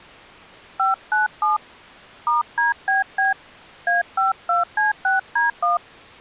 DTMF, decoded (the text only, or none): 597 *DBB A52C6D1